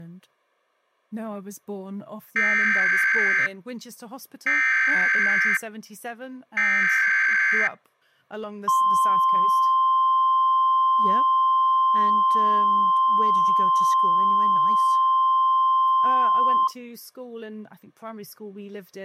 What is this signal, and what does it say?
Emergency Alert System (SAME) tones (header bursts, then the 1050 Hz attention tone), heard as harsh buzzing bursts, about 520.83 baud.